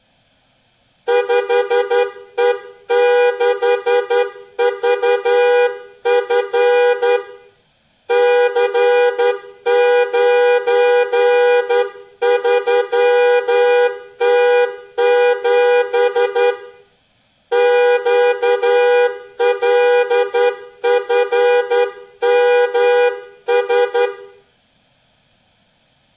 Morse code, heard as a horn, hand-sent with a straight key, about 11 wpm, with room echo. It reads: 5E6VF C93T7 QLFMS